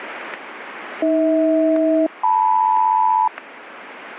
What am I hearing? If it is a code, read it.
Aircraft SELCAL, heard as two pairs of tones, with radio static. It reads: AH-LM